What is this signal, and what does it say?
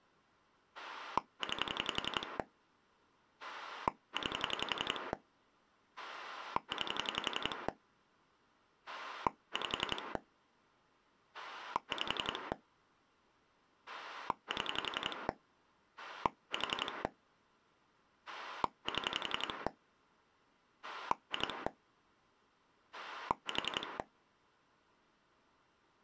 Pulse dialling, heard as a rotary dial, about 11 pulses a second. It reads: 9 9 9 5 5 7 4 7 2 4